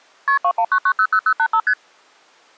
Multi-frequency trunk signalling (R1, as on North American trunks), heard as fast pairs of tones, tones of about 70 ms. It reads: KP 219900085 ST